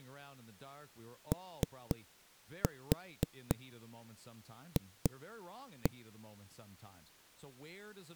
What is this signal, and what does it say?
Tap code, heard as knocks on a wall, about 4 knocks a second, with speech in English. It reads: OF